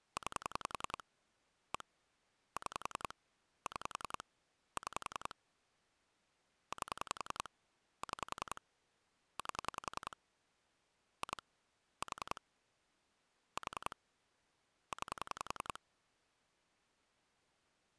Pulse dialling, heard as clicks on a phone line, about 10 pulses a second. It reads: 9 1 6 6 6 8 6 8 2 4 4 9